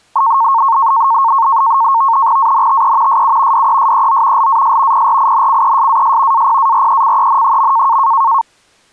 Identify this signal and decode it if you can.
NAVTEX (SITOR-B), 100 baud, 170 Hz shift, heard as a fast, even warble, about 1000 Hz centre. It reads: ANTE SU DESEO LAS PRINCESAS APARECEN.